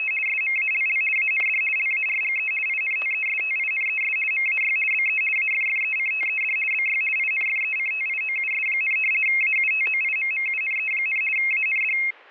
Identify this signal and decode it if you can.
RTTY (50 baud, 450 Hz shift), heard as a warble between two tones, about 2350 Hz centre, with static crashes. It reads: … SMALL AND LARGE INTESTINES MAY BE AFFECTED BY INFECTIOUS, AUTOIMMUNE, AND